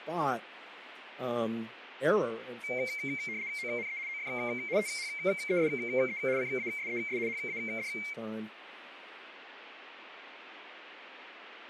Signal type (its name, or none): RTTY